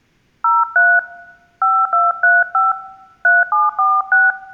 DTMF, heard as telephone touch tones, dialled by hand, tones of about 210 ms. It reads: 03 5235 3746